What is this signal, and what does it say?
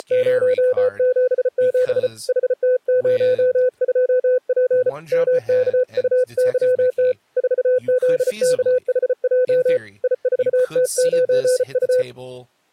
Morse code, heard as a keyed tone, hand-sent with a bug key, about 34 wpm, 500 Hz, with speech in English. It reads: … HT02P MKUYT 4ZKHJ I4T9U